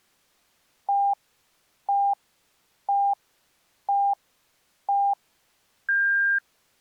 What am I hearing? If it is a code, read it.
Radio time signal (five pips and a higher one, as on Chinese radio), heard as pips.